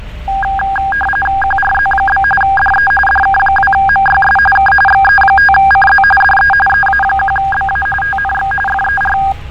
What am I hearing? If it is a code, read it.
RTTY (45.45 baud, 850 Hz shift), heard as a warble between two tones, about 1210 Hz centre, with fading and street noise. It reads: QRZ? DE DK2MYS K XE5CZ DE EA1BA TNX FER